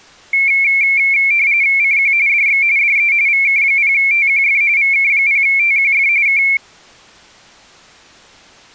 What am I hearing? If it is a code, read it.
RTTY (45.45 baud, 170 Hz shift), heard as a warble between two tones, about 2250 Hz centre. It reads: CQ DX DE VK0TQF VK0TQF K